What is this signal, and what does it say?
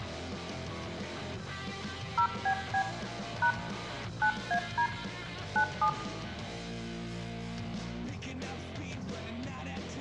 DTMF, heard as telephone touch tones, dialled by hand, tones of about 90 ms, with room echo. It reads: 0BB # 9AD 97